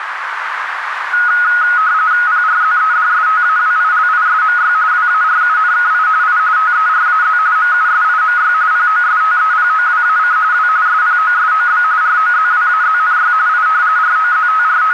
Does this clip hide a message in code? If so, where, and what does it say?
Yes: RTTY (45.45 baud, 170 Hz shift) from 1.1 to 14.9 s, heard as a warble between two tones, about 1360 Hz centre, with radio static and a narrow filter. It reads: PRZEDSTAWILISMY WARUNKI I TERAZ MUSIMY POSTEPOWAC W SPOSOB ROZWAZNY I …